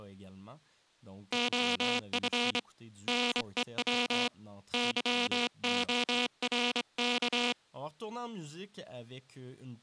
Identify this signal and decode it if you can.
Morse code, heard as a buzzer, hand-sent with a straight key, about 25 wpm, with speech in French. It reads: OF NEW YORK